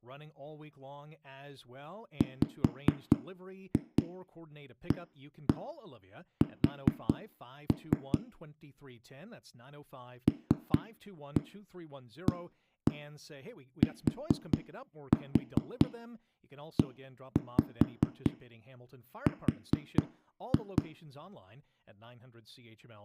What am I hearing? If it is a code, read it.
Tap code, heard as knocks on a wall, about 4 knocks a second, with room echo and speech in English. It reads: WAS LATER